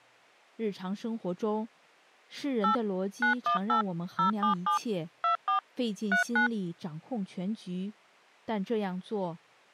DTMF, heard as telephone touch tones, dialled by machine, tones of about 110 ms. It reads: 8 918 077 24 39